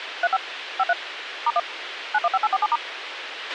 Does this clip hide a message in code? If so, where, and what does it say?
Yes: DTMF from 0.2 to 2.8 s, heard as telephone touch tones, dialled by machine, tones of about 40 ms, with radio hiss and a squelch burst at the end. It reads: 35 53 *1 915847*